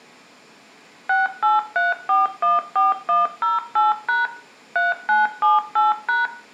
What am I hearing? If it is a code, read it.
DTMF, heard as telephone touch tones, dialled by machine, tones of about 170 ms, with room echo. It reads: 683414108# 3978#